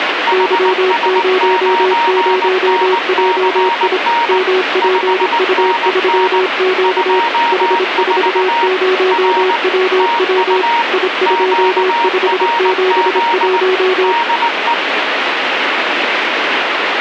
Morse code, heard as two keyed tones, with radio static. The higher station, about 19 wpm, 940 Hz: HS9NCN 5NN 24 R TU QRZ DE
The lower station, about 26 wpm, 370 Hz: Y00JI MPU3Q H40WW I2571